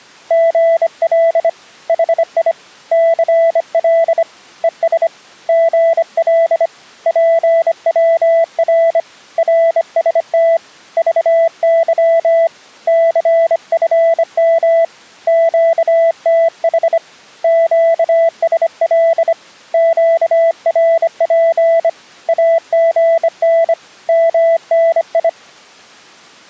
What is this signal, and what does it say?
Morse code, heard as a keyed tone, hand-sent with a bug key, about 25 wpm, 660 Hz. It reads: GL HI CL ES GL PWR RST VY CFM QTH QSL QRP AGN MNI